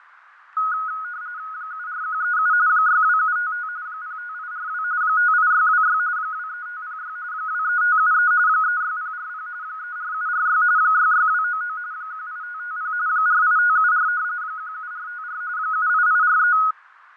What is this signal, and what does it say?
RTTY (45.45 baud, 170 Hz shift), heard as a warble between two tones, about 1360 Hz centre, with radio static, fading and a narrow filter. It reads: 74137 62755 05842 58626 23506 23573 36040 34746 66299 18550 48574 17454 78843